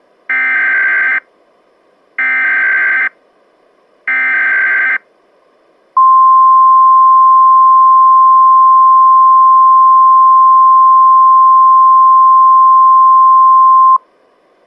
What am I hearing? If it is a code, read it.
Emergency Alert System (SAME) tones (header bursts, then the 1050 Hz attention tone), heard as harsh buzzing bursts, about 520.83 baud.